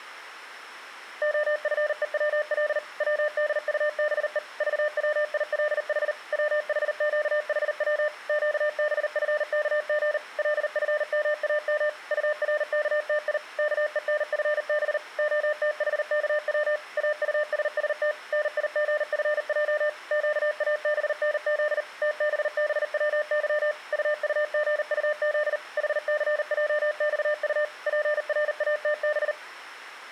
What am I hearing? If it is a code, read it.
Morse code, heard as a keyed tone, machine-sent, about 39 wpm, 600 Hz. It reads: OFEWL WDUBE VWILH WHQHW QBFKG LFMAM URKTI KENFB OTHKW AUSST NIGFJ QABNZ TBBWY UUGUZ HCJXU PRATB